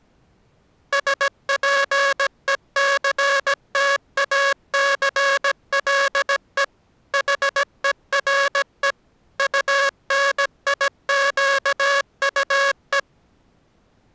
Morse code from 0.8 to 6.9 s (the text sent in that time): SPECTACLE